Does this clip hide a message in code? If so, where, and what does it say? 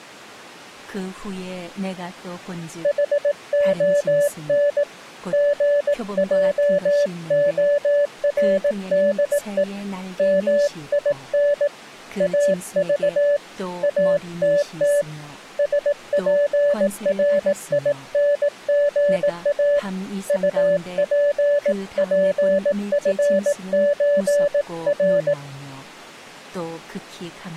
Yes: Morse code (with Swedish letters) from 2.8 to 25.4 s, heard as a keyed tone, hand-sent with a paddle, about 18 wpm, 580 Hz, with speech in Korean. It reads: HON GJORDE MIN AV ATT SPRINGA UPPFÖR